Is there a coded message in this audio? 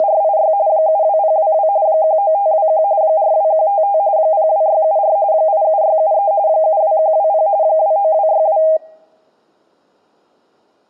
Yes: RTTY (45.45 baud, 170 Hz shift) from 0.0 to 8.8 s, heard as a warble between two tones, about 720 Hz centre. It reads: … 72022 19521 42155 02674 87673 72120 29262